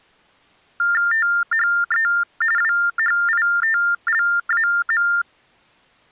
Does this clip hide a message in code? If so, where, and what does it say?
Yes: TTY/TDD text telephone tones (45.45 baud Baudot) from 0.8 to 5.2 s, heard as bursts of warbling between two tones, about 400 Hz shift, 1600 Hz centre. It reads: THE WHITLAM